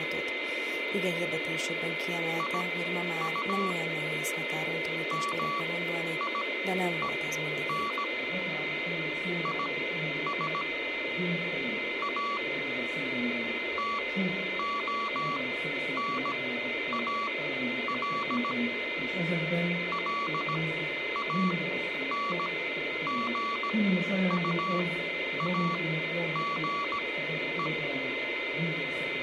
Morse code, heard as a keyed tone, machine-sent, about 17 wpm, spaced as for 10 wpm, 1140 Hz, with a steady whistle near 2070 Hz. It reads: IU MIEN IS A TONAL LANGUAGE